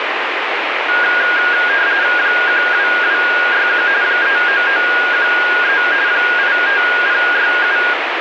RTTY (45.45 baud, 170 Hz shift), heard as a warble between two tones, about 1550 Hz centre, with radio static. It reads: 12261 39913 85067